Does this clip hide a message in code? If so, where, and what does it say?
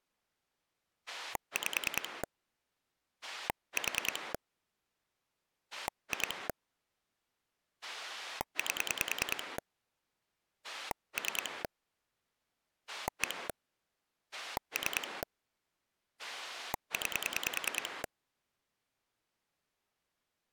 Yes: pulse dialling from 1.1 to 18.1 s, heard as a rotary dial, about 10 pulses a second. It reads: 5 4 2 8 3 1 3 9